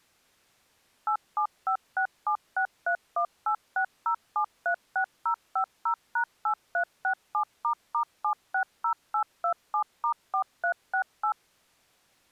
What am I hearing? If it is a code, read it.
DTMF, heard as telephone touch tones, dialled by machine, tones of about 90 ms. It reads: 87567631860736050#8367**760827*4368